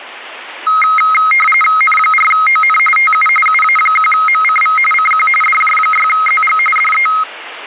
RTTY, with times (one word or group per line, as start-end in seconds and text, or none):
1.8-2.8 N4ON
3.0-3.3 TU
3.5-4.8 UA1MCV
4.9-5.3 CQ
5.4-6.6 DJ6ZG
6.8-7.1 DE